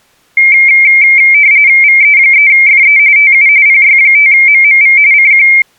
RTTY (45.45 baud, 170 Hz shift), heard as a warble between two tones, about 2200 Hz centre. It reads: VE3FE TU PY5MMV CQ